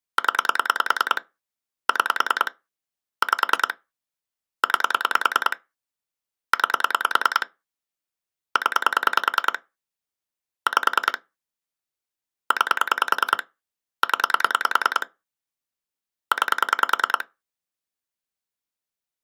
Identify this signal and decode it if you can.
Pulse dialling, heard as clicks on a phone line, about 10 pulses a second. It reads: 0 6 5 9 9 0 5 9 0 9